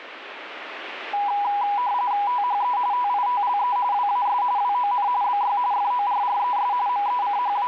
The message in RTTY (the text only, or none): THE TITLE WAS WON BY FORRES …